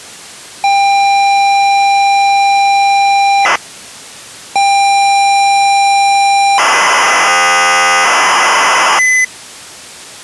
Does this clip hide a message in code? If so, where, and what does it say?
Yes: ZX Spectrum tape loading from 0.6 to 9.2 s, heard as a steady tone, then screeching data.